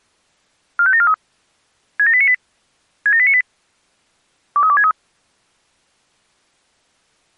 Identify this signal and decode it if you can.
Five-tone selective call (ZVEI), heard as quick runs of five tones, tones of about 70 ms. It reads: 45743 67898 67898 23263